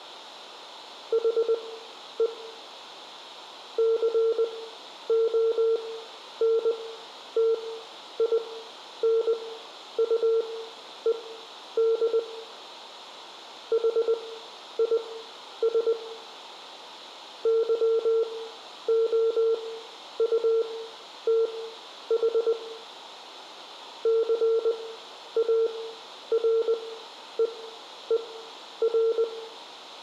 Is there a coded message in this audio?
Yes: Morse code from 1.1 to 29.3 s, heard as a keyed tone, machine-sent, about 20 wpm, spaced as for 10 wpm, 450 Hz, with room echo. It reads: HE CONTINUED HIS YOUTH CAREER